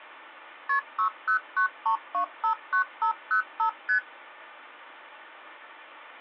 Multi-frequency trunk signalling (R1, as on North American trunks), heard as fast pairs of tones, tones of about 100 ms. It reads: KP 6093259505 ST